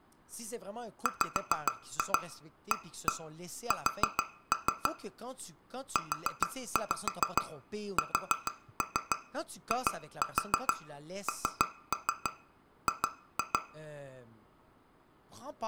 Tap code, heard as taps on glass, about 6 knocks a second, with room echo and speech in French. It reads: WAS USING